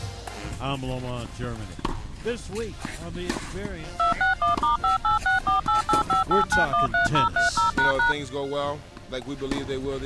DTMF, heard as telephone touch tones, dialled by machine, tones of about 130 ms. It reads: 261*58648858913030##